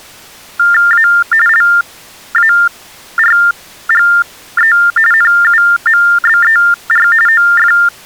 TTY/TDD text telephone tones (45.45 baud Baudot), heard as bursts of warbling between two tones, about 400 Hz shift, 1600 Hz centre. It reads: A LARGE NUMBER OF